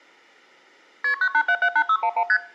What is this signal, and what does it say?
Multi-frequency trunk signalling (R1, as on North American trunks), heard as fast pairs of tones, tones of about 70 ms. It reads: KP 98778611 ST